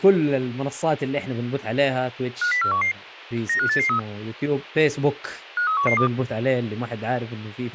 Five-tone selective call (CCIR), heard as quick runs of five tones, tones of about 100 ms, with speech in Arabic. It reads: 50411 95883 53112